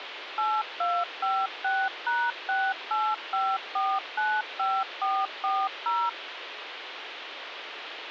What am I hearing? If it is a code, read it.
DTMF, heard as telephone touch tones, dialled by machine, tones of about 240 ms, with phone line noise. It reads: 8256#685495440